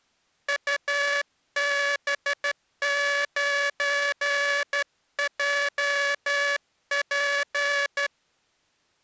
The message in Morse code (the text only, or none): UB9JP